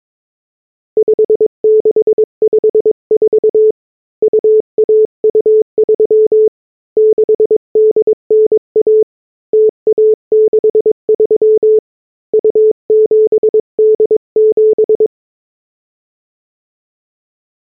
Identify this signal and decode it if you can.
Morse code (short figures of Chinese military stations), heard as a keyed tone, hand-sent with a paddle, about 22 wpm, 430 Hz. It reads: 5654 2123 6891 0163 2787